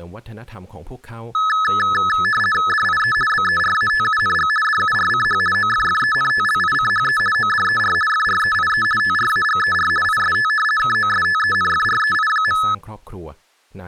RTTY (50 baud, 450 Hz shift), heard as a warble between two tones, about 1500 Hz centre, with speech in Thai. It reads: DIE BERATUNG DURCH OFFENTLICHE ODER FREIE TRAGER IST KOSTENFREI.